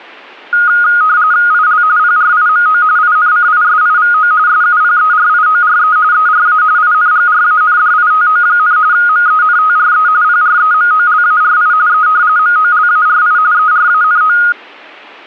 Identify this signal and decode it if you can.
RTTY (45.45 baud, 170 Hz shift), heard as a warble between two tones, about 1340 Hz centre. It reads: IL PRIMO INCISIVO SUPERIORE ERA INGRANDITO, MENTRE PREMOLARI E MOLARI ERANO